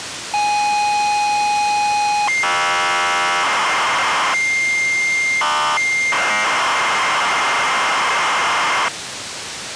ZX Spectrum tape loading, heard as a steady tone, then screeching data, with tape hiss.